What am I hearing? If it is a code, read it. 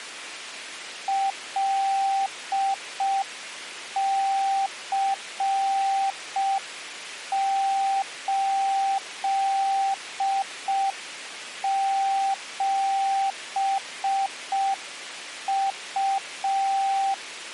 Morse code, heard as a keyed tone, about 5 wpm, 780 Hz. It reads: LC87U